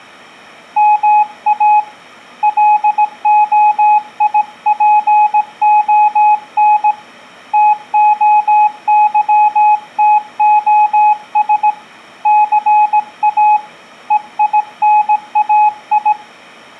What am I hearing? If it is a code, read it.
Morse code (Greek alphabet), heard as a keyed tone, hand-sent with a paddle, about 17 wpm, 840 Hz. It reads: ΜΑ ΛΟΙΠΟΝ ΤΟΥΤΟΣ ΘΑ ΕΙΝΑΙ